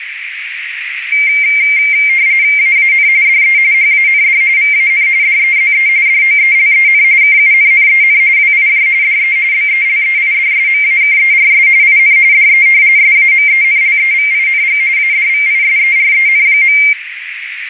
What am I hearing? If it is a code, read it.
RTTY (45.45 baud, 170 Hz shift), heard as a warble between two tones, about 2200 Hz centre, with radio static and a narrow filter. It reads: AAN DE HAND VAN DEZE DOELEN KUNNEN WIJ DE BELEIDSMAKERS IN DE SAMENLEVING ADVISEREN.